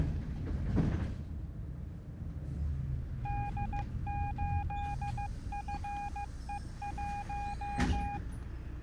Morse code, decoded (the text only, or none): D8FE1